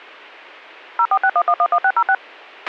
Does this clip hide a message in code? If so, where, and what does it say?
Yes: DTMF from 1.0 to 2.1 s, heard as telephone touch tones, dialled by machine, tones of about 60 ms, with a squelch burst at the end. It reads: 0461111606